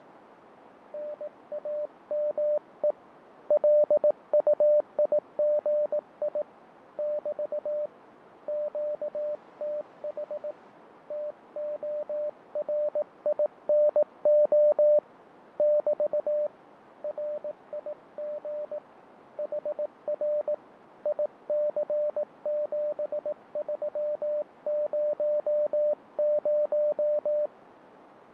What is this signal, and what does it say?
Morse code, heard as a keyed tone, hand-sent with a paddle, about 18 wpm, 600 Hz, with radio static, fading and a narrow filter. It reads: NAME LUIGI <BT> QTH TORINO <BT> RIG HR IC7300